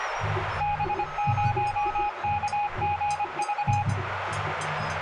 Morse code, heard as a keyed tone, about 25 wpm, 830 Hz, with radio static, a narrow filter and room echo. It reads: B0KGV